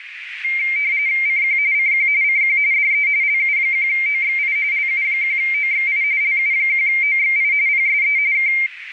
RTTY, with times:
1.3-1.6 CQ
1.7-2.1 CQ
2.2-2.6 CQ
2.7-3.1 DE
3.2-4.6 LU1OXI
4.7-6.0 LU1OXI
6.2-7.5 LU1OXI
7.7-8.2 PSE
8.3-8.5 K

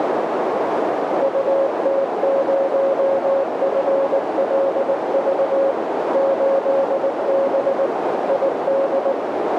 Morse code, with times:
1.2-5.7 UT0FLV
6.1-7.9 8B
8.3-9.1 ID

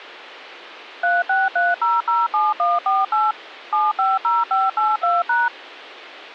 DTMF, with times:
1.0-3.3 363007148
3.7-5.5 750582#

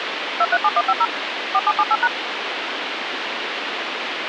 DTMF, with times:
0.4-1.1 237150
1.5-2.1 4778#

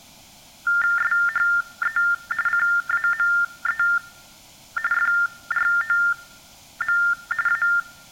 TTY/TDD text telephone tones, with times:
1.0-2.0 SHE
2.5-3.8 CAME
4.9-7.0 FROM
7.5-7.6 A

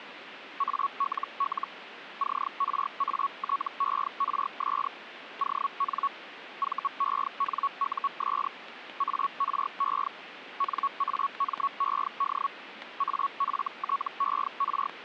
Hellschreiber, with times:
0.6-1.7 ALL
2.2-4.9 CRATERS
5.4-6.1 ON
6.6-8.5 VENUS
9.0-10.1 ARE
10.6-12.5 NAMED
13.0-14.9 AFTER

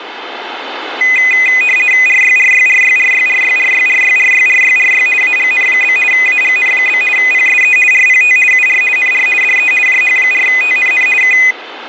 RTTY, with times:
2.1-5.1 RYRYRYRYRYRYRYRYRYRY
5.2-6.0 AGN?
6.1-7.0 AGN?
7.2-7.8 PSE
7.9-8.4 RPT
8.5-8.8 UR
9.0-9.3 NR
9.4-9.7 DE
9.9-11.1 JH4TNN
11.2-11.4 K

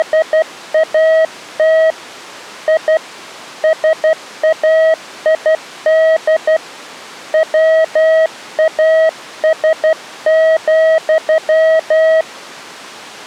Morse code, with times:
0.0-1.9 …
2.7-3.0 I
3.6-6.6 SAID
7.3-12.2 WAS,

